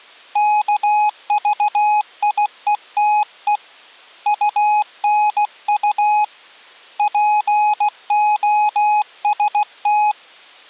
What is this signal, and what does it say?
Morse code, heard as a keyed tone, hand-sent with a paddle, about 16 wpm, 840 Hz. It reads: KVIETE UNU POST